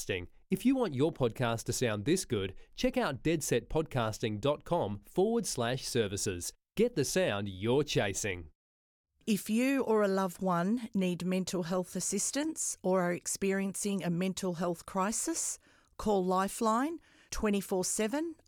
Speech in English. There is no code.